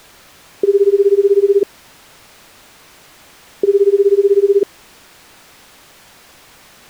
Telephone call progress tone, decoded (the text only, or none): ringback tone